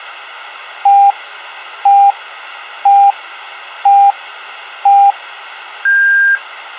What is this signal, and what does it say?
Radio time signal (five pips and a higher one, as on Chinese radio), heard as pips.